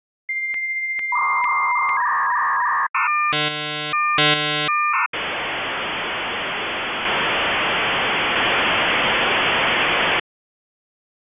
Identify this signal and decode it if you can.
Dial-up modem handshake (V.34 or later), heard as a whistle, warbles, then hiss.